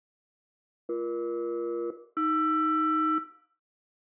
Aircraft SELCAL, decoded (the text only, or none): BE-AR